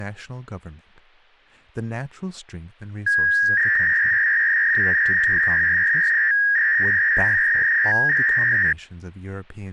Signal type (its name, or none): 300-baud modem data